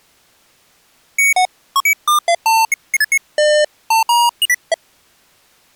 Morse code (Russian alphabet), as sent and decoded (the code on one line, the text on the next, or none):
none